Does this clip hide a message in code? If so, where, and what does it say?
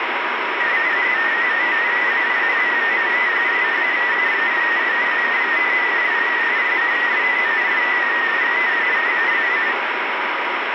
Yes: multi-tone FSK (Olivia or MFSK type), about 250 Hz wide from 0.6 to 9.8 s, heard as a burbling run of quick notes, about 31.25 baud, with heavy radio static.